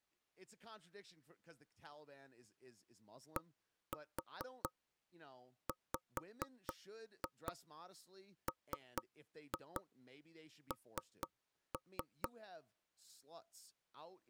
Tap code, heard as knocks on wood, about 4 knocks a second, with speech in English. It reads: DWMN